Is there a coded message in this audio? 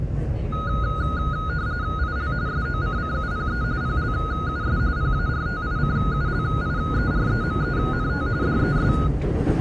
Yes: RTTY (45.45 baud, 170 Hz shift) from 0.5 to 9.1 s, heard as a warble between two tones, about 1350 Hz centre, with the noise inside a subway train. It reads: IL SOCCUPE PLUS PARTICULIEREMENT DES